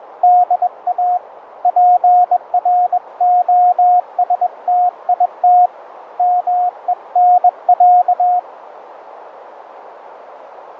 Morse code (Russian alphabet), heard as a keyed tone, hand-sent with a bug key, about 21 wpm, 720 Hz, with radio static and a narrow filter. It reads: ДА ПРОСТИТ МЕНЯ